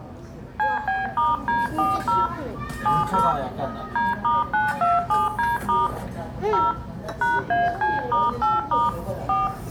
DTMF, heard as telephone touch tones, dialled by hand, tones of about 180 ms, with room echo and the noise of a restaurant. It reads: CB*D40 70 D*927D* 0 #AC*8* 4